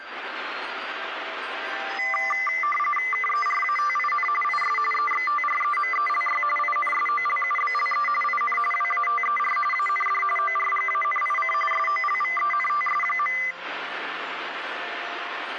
RTTY (45.45 baud, 850 Hz shift), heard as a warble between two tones, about 1600 Hz centre, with radio static. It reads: KERATIN IS EXTREMELY INSOLUBLE IN WATER AND ORGANIC SOLVENTS.